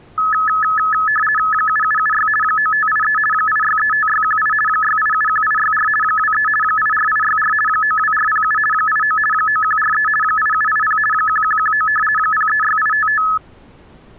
RTTY (50 baud, 450 Hz shift), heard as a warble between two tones, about 1500 Hz centre. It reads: 7776 9583 8635618 6871864 23 84864 92407 89 9143 8780 1119 036855